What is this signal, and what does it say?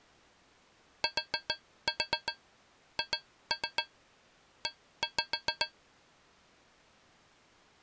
Tap code, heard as taps on a metal pipe, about 7 knocks a second. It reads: THE